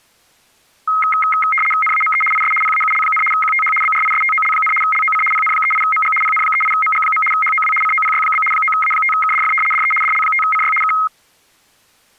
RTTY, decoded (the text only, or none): NAME IS PAUL, QTH BRISTOL, LOC PN38MG PN38MG. HOW COPY? 9A5KDF DE DL5CY K